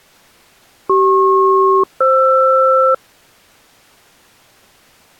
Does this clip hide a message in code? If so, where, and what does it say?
Yes: aircraft SELCAL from 0.9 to 2.9 s, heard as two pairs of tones. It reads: CP-FR